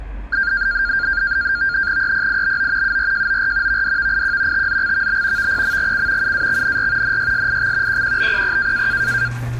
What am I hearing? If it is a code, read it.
NAVTEX (SITOR-B), 100 baud, 170 Hz shift, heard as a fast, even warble, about 1500 Hz centre, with the noise inside a lift. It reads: EPIBO URJOR VDVIQ TZXVB VPMGC UAXNR NYSIX QQBPP